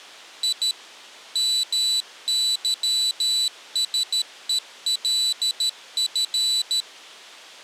Morse code, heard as a high beeper, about 13 wpm, 3950 Hz. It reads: I MYSELF